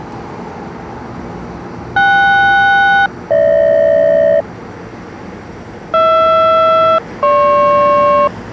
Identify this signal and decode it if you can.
Aircraft SELCAL, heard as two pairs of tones, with street noise. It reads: KS-GH HR-GP